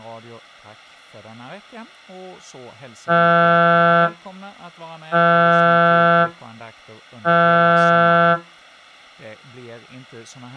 Ship horn signal, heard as a ship's horn, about 170 Hz, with speech in Swedish. 3 short. At sea: I am operating astern propulsion.